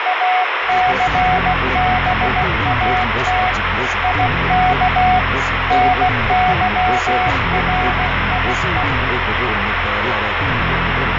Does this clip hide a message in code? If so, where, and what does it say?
Yes: Morse code (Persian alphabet) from 0.0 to 8.9 s, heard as a keyed tone, hand-sent with a paddle, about 16 wpm, 740 Hz, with heavy radio static and fading. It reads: اثبات یک نظریه